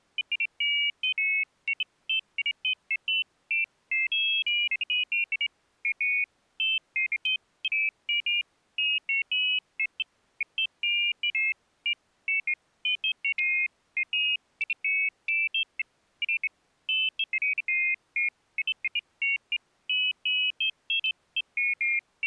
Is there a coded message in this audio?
No, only pairs of high tones at irregular times.